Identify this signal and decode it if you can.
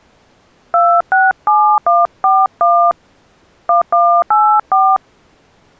DTMF, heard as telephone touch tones, dialled by hand, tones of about 220 ms. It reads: 267141 1184